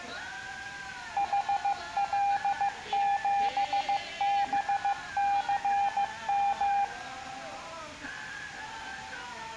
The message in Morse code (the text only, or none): HL7BCM